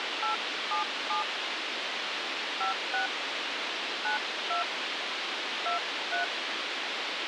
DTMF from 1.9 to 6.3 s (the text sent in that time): 56 92 23